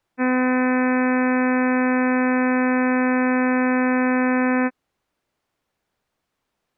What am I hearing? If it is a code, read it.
Ship horn signal, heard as a ship's horn, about 250 Hz. 1 long. At sea: a vessel nearing a blind bend, or under power and making way in fog.